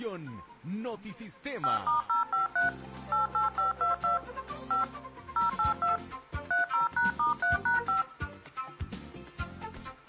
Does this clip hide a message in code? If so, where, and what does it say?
Yes: DTMF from 1.6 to 8.0 s, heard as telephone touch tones, dialled by machine, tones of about 140 ms. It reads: 5*053 88522 5 082 30#*3#5